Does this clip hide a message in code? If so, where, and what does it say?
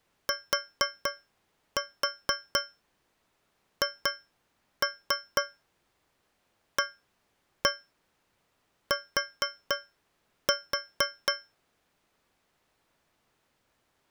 Yes: tap code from 0.3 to 11.5 s, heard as taps on a metal pipe, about 4 knocks a second. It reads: THAT